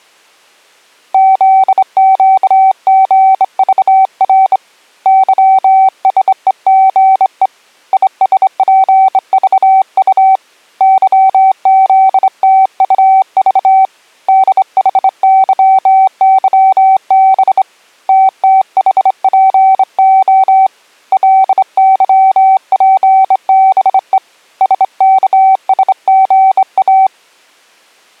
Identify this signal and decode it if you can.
Morse code, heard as a keyed tone, hand-sent with a straight key, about 25 wpm, 770 Hz. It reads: ZQGVR YSEGE ISPVU YZTUV DHYYB TTHPO LYPBE SKSGA